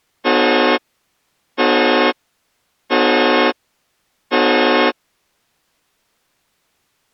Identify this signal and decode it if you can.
Train horn signal, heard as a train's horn. 4 short. On North American railways: a request for a signal to be given or repeated.